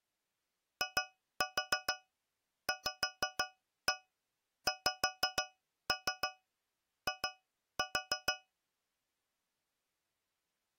Tap code, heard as taps on a metal pipe, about 6 knocks a second. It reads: IVXI